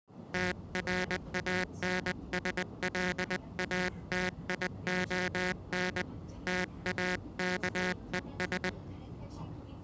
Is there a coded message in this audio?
Yes: Morse code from 0.3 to 8.8 s, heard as a buzzer, hand-sent with a paddle, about 20 wpm, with the noise inside a subway train. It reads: TRANSLATION TAKES